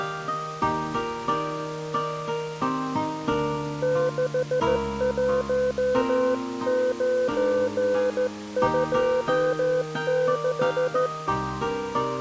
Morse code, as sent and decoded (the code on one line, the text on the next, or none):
-.... .---- ----. ..--- -....
61926